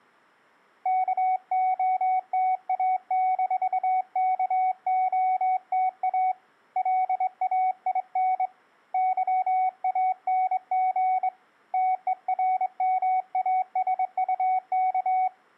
Morse code, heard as a keyed tone, hand-sent with a straight key, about 23 wpm, 750 Hz. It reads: KOTA-KOTA LAIN YANG TERMASUK